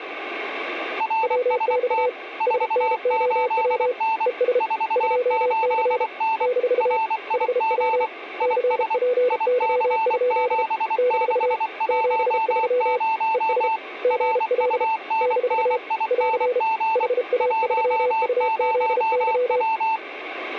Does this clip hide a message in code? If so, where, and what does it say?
Yes: Morse code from 0.9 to 20.0 s, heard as two keyed tones. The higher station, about 24 wpm, 890 Hz: RST 48N 48N RIG IS IC7610 RUNNING 10W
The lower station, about 33 wpm, 500 Hz: WX SNOW ES 2C - HW CPY? - 73 ES GL - <AR> HA3UZY